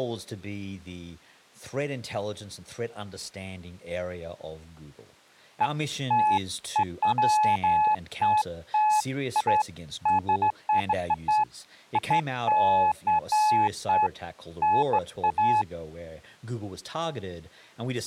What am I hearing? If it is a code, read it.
Beeps of irregular length, with speech in English. There is no code.